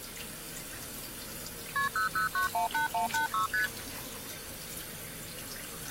Multi-frequency trunk signalling (R1, as on North American trunks), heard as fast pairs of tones, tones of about 120 ms, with the noise of a restroom. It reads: KP 00918186 ST